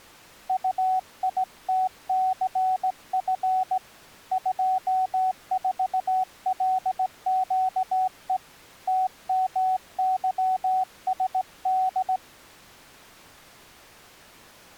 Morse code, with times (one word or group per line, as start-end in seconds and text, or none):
0.5-3.8 UITCF
4.3-8.4 24LQE
8.9-12.2 TMYSD